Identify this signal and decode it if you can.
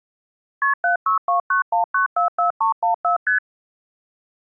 Multi-frequency trunk signalling (R1, as on North American trunks), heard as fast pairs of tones, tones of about 120 ms. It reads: KP 76291944314 ST